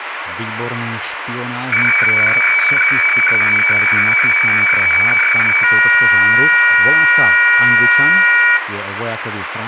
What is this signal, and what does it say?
Weather fax (radiofax), 120 lines a minute, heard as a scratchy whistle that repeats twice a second, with radio static, room echo and speech in Slovak.